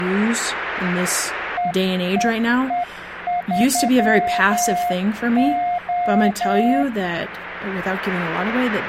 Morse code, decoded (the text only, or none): EEE3O